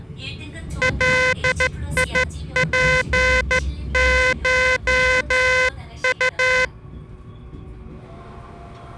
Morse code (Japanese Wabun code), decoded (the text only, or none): ガツコウ